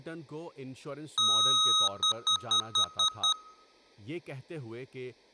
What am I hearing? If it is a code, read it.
Beep code, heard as beeps from a small speaker, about 1270 Hz, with room echo and speech in Urdu. 1 long, 6 short.